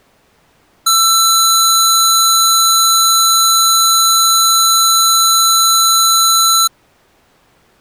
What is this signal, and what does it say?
A steady tone. There is no code.